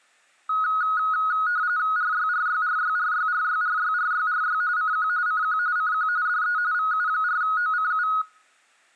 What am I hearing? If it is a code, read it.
RTTY (45.45 baud, 170 Hz shift), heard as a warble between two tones, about 1360 Hz centre. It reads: RYRYRYRYRYRYRYRY CQ CQ CQ DE VU4OCU